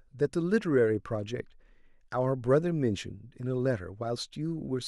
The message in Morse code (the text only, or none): none